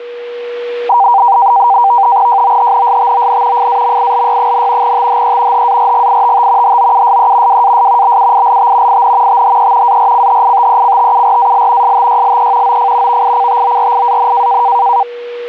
NAVTEX (SITOR-B), 100 baud, 170 Hz shift, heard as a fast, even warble, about 870 Hz centre, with a steady whistle near 480 Hz. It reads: JOHNSTON FAMILY, THE HARGITT HOUSE WAS BUILT IN THE ARCHITECTURAL STYLE OF VICTORIAN